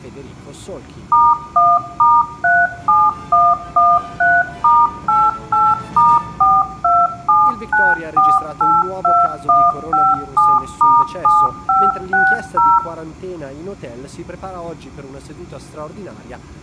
DTMF, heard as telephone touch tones, dialled by machine, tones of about 220 ms, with room echo. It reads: *1*37113*88*4279482157*7560